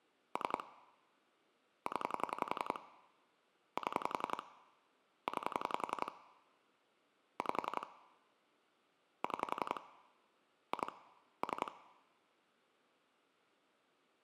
Pulse dialling, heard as clicks on a phone line, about 11 pulses a second. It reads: 3 0 7 9 5 6 2 3